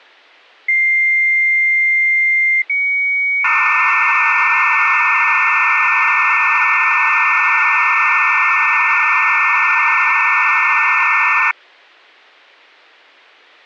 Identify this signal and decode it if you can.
Dial-up modem handshake (low-speed, two carriers), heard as two whistles, then hiss.